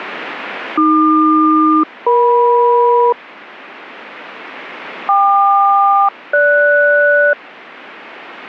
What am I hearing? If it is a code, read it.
Aircraft SELCAL, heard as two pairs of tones. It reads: AQ-EM KQ-GS